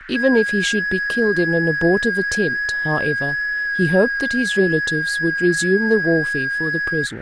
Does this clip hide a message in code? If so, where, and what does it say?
Yes: FT8 (one signal) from 0.1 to 7.1 s, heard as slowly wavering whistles, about 6.25 baud, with radio static, a narrow filter and speech in English.